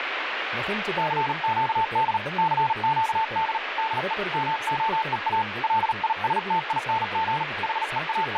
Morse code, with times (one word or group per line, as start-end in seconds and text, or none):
1.0-2.2 CQD
2.4-3.6 CQD
3.8-4.1 DE
4.3-5.4 MOEA
5.6-7.4 LISTING
7.6-8.4 …